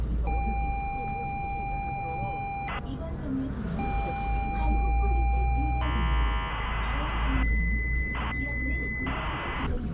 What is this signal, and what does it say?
ZX Spectrum tape loading, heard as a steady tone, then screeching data, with the noise inside a bus.